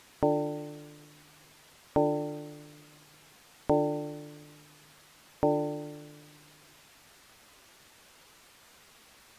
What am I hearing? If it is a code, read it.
Clock strike, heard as a bell. 4. Four o'clock.